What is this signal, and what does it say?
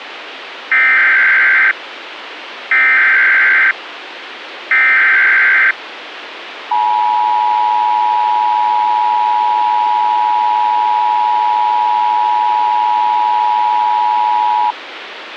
Emergency Alert System (SAME) tones (header bursts, then the 853 and 960 Hz attention tone), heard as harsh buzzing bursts, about 520.83 baud, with radio hiss.